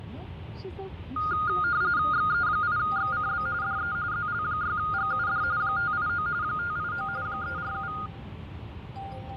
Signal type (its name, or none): RTTY